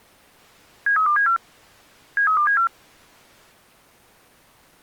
Five-tone selective call (CCIR), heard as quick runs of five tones, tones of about 100 ms. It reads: 73274 73274